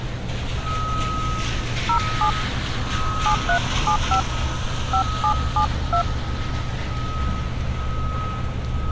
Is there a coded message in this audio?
Yes: DTMF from 1.9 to 6.0 s, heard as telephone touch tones, dialled by hand, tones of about 90 ms, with street noise. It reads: 07 7375 5772